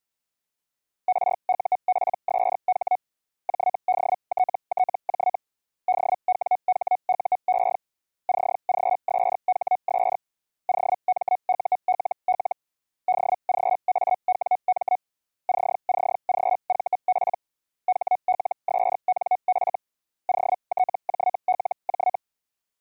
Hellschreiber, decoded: RUPSH JDTTJ DWHUE CGSHS OMULL DGAWM CCGVP HLSNF OTJLJ

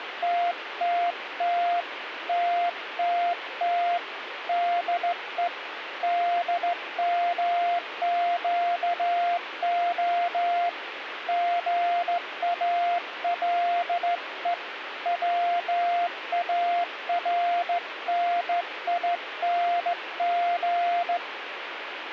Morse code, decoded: TTT TTT DE DMQO GALE WARNING

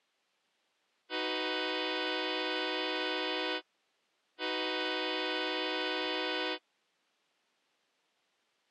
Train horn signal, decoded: 2 long

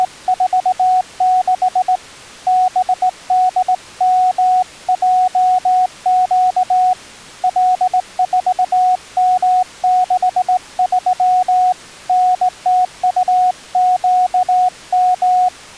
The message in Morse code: … BDMJQ L4M63 NTUQM

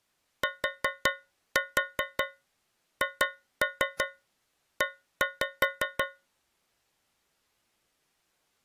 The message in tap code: THE

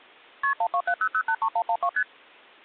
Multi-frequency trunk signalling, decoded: KP 1270083112 ST

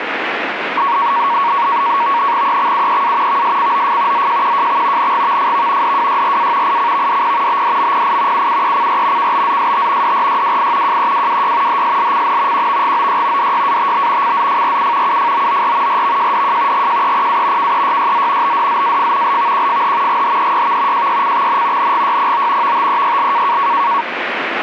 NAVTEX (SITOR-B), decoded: EXUEA VSCOF ZJQJX NGVFV DWYRA ICVDP BDMPI UUECR KBZST DRYWI JEWWY HSLCN QVGOY DYATB CZFRU UFOOR RVJDJ GJEPA KEYYZ BDZAF LVQFH GHEYV JYCXN NGYPO VTEYL

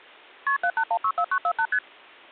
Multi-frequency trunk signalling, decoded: KP 78164948 ST

